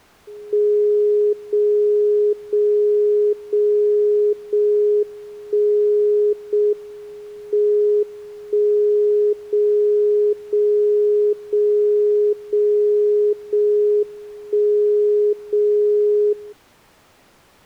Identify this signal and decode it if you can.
Radio time signal (JJY), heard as a tone whose level steps once a second, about 420 Hz. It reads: 0 0 0 0 1 0 M 1 0 0 0 0 0 1 0 0